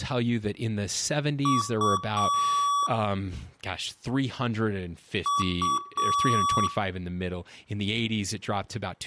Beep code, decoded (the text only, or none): 2 short, 1 long